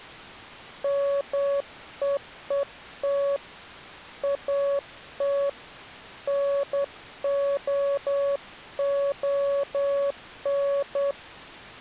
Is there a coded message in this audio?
Yes: Morse code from 0.8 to 11.2 s, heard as a keyed tone, hand-sent with a straight key, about 10 wpm, 560 Hz. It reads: MEET AT NOON